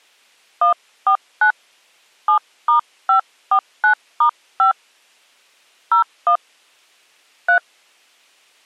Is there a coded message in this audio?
Yes: DTMF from 0.6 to 7.6 s, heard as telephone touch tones, dialled by hand, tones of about 100 ms. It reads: 149 7*549*5 01 3